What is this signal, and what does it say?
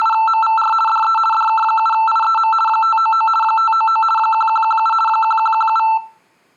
RTTY (50 baud, 450 Hz shift), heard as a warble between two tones, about 1110 Hz centre, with room echo. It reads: … DE DK7IEM 599 599 1117 1117